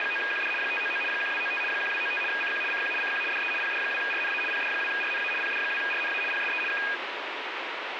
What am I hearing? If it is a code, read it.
RTTY (75 baud, 850 Hz shift), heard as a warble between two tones, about 2050 Hz centre, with radio static. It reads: … 599 1295 1295 CQ CQ CQ DE PD2RNA PD2RNA PD2RNA PSE K